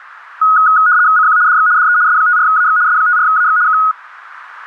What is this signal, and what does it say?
RTTY (75 baud, 170 Hz shift), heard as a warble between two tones, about 1360 Hz centre, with radio static. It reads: CQ DX DE S54AX S54AX K